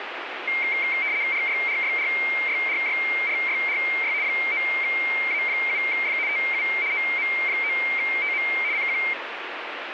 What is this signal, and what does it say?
RTTY (75 baud, 170 Hz shift), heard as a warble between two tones, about 2200 Hz centre, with radio static. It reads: RYRYRYRYRYRY 9A7F TU OM9TM CQ